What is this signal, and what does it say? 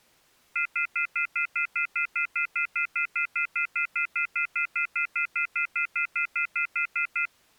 Telephone call progress tone (North American plan), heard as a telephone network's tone, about 1400, 2050, 2450, 2600 Hz, 0.1 s on and 0.1 s off. Off-hook warning tone.